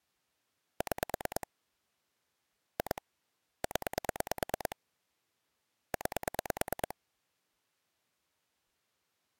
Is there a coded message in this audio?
Yes: pulse dialling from 0.8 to 6.9 s, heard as clicks on a phone line, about 9 pulses a second. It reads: 6 2 0 9